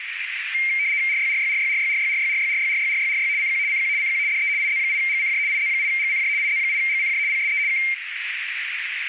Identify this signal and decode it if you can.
RTTY (75 baud, 170 Hz shift), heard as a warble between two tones, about 2200 Hz centre, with radio static and a narrow filter. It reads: RYRYRYRYRYRYRYRYRYRYRY CQ CQ CQ DE IZ8GCJ IZ8GCJ IZ8GCJ PSE K